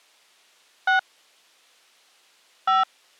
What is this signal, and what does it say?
DTMF, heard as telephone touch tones, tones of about 130 ms. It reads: 6 5